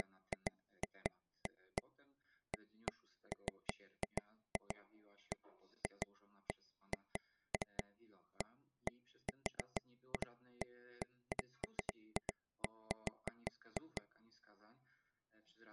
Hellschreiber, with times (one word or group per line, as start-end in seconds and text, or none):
none